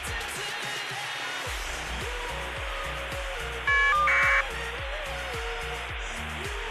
Caller ID data burst, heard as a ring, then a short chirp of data, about 1200 baud, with phone line noise.